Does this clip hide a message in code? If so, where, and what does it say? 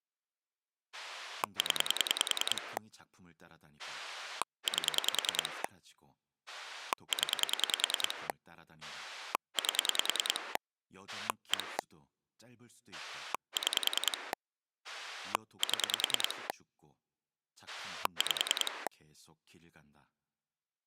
Yes: pulse dialling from 0.9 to 18.9 s, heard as a rotary dial, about 10 pulses a second, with speech in Korean. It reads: 0 8 0 8 1 6 7 5